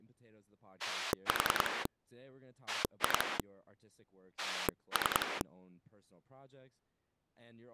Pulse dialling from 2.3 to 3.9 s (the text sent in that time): 2